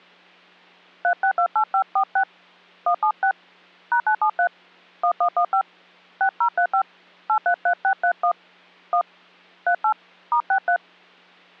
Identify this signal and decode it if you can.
DTMF, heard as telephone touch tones, dialled by hand, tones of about 80 ms. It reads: 3628546 176 #973 1115 6035 833631 1 38 *63